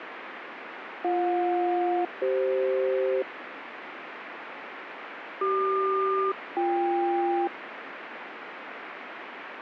Aircraft SELCAL, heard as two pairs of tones, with radio static. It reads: BJ-CF CQ-BK